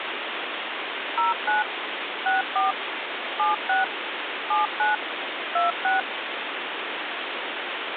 DTMF, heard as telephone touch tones, dialled by machine, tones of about 150 ms, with phone line noise. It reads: 09 64 76 79 26